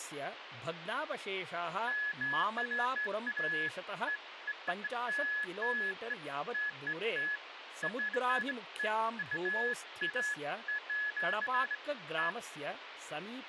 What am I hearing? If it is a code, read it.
Beeps of irregular length, with phone line noise and speech in Sanskrit. There is no code.